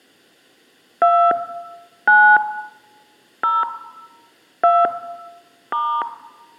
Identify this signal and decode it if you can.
DTMF, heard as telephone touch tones, dialled by hand, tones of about 260 ms, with room echo. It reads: 2 9 0 2 *